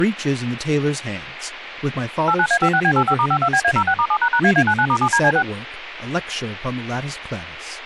DTMF, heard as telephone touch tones, dialled by machine, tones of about 70 ms, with speech in English. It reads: 89A56B85*52BA06*7##AA99*7DC6